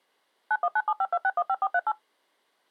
DTMF, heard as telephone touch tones, dialled by machine, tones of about 50 ms. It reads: 919752615438